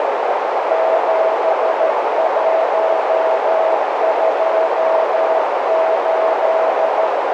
Morse code, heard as a keyed tone, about 13 wpm, 650 Hz, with heavy radio static and a narrow filter. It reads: 7128